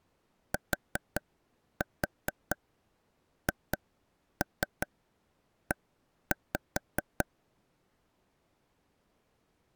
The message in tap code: THE

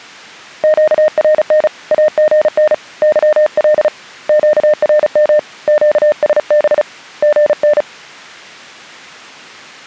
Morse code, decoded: QRN AGN YL QRM QSB GN

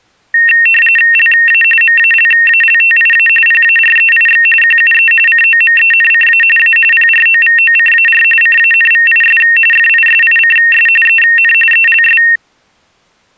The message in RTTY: LA MALALTIA PAREIX QUE COMENCA A PROVOCAR CANVIS FISICS EN ELS

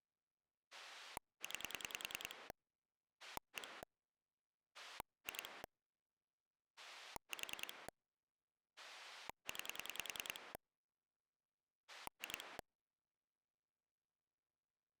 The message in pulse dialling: 9 1 2 4 9 2

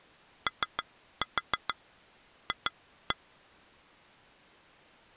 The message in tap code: OF

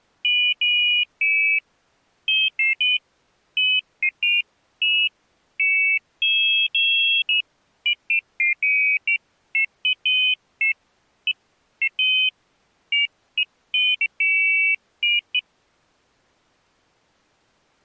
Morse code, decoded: none

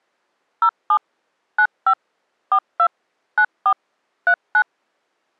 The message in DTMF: 07 95 42 94 39

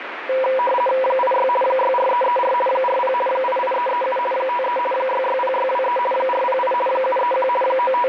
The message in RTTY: 86 64334 40 88337 53 660623 408 731 …

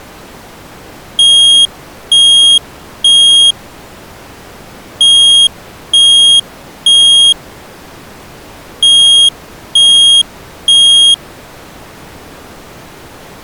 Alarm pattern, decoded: temporal three

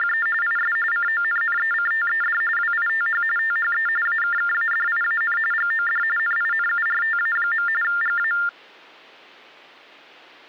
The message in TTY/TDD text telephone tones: … IS CONNECTED WITH THE AKKADIAN GOD NINURTA. GA

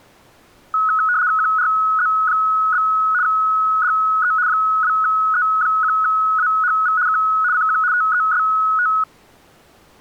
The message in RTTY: QRZ? DE 2E1AHV K CQ TEST

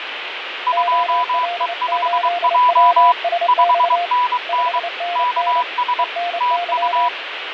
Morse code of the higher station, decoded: 2E5J 5NN KS TU

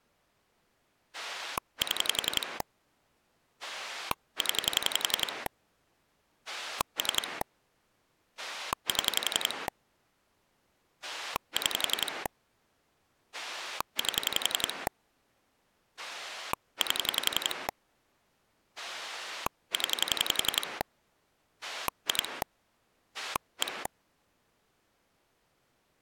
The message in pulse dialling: 7 0 3 7 6 8 8 0 2 1

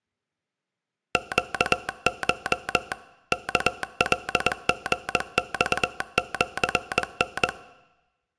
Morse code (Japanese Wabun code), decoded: ネコ ワカリマシタ

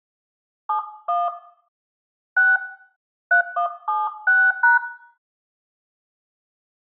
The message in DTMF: 71 6 3176#

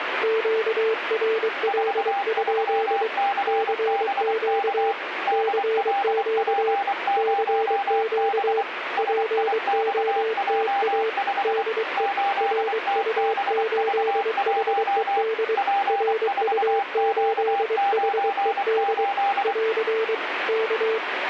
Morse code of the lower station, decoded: QRL? CQ CQ CQ POTA DE RU8HED RU8HED <AR> K

